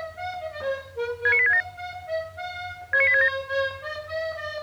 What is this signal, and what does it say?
Five-tone selective call (ZVEI), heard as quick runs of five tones, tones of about 70 ms. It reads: 69867 69867